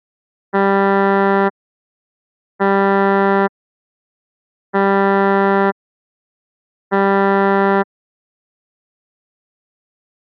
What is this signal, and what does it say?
Ship horn signal, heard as a ship's horn, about 200 Hz. 4 short. At sea: a pilot vessel's identity signal in fog.